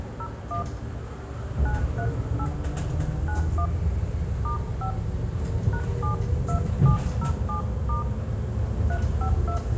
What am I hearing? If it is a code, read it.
DTMF, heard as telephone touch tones, dialled by hand, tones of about 100 ms, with room echo and the noise inside a bus. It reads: 01 938 91 *5 #72707* 352